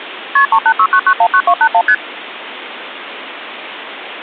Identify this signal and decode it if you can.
Multi-frequency trunk signalling (R1, as on North American trunks), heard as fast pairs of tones, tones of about 70 ms, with phone line noise. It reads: KP 3869919281 ST